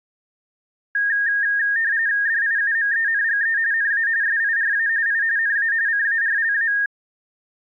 RTTY (45.45 baud, 170 Hz shift), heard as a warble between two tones, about 1750 Hz centre. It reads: DIUMENGE NA SIRA I NA CARLA